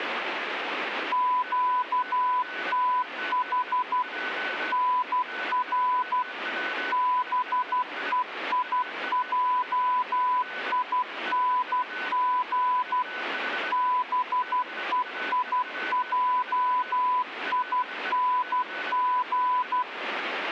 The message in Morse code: QTH NR BEIJING BEIJING

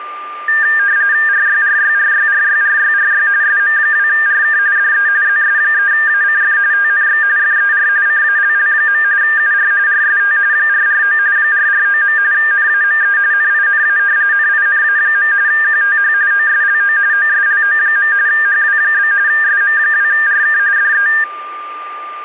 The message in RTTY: RYRYRYRYRYRY SM2RK DE ZS3ACF TNX FER CALL. UR RST 449 449. NAME NINA NINA. QTH OSLO OSLO. HW? SM2RK DE

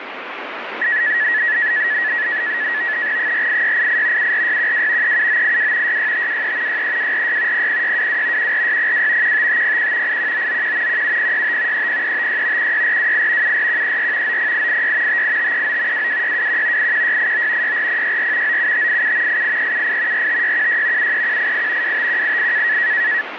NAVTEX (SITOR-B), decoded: 48688 74612 37982 66523 63246 00622 14602 15501 81991 17065 30356 16428 74134 90886 58539 22621 81689 64064 97587 88378 45616 73188 25188

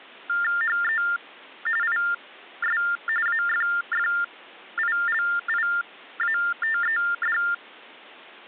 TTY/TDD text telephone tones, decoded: HE IS AFFILIATED

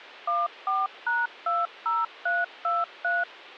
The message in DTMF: 14#20323

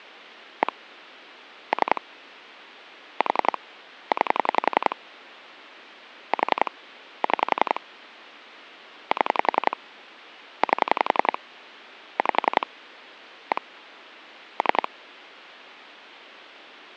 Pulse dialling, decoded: 1 3 4 9 4 6 7 8 5 1 3

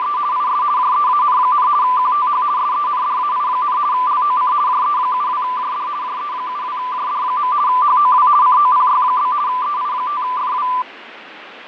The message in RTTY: … IS JEAN, QTH SENDAI, LOC JE72JD JE72JD. HOW COPY? EI5FW

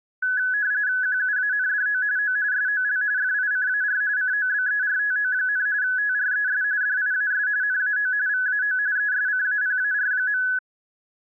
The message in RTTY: QUANDO O SOL FICAR COBERTO, TRES DIAS NAO VAO ESCAPAR.

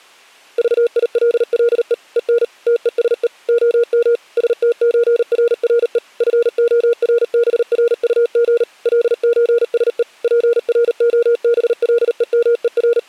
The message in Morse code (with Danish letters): VILLE EN TESE OM STØRRE FORBRUG LØSE …

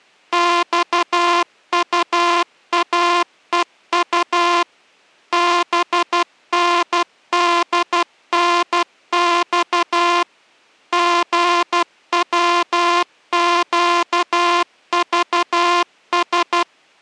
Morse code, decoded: XUAEU BNDNX GWQVS

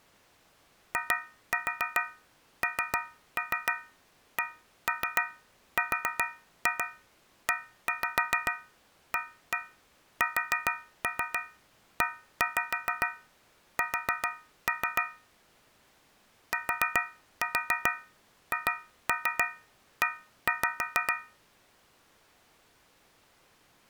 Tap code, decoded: INCREASES THE

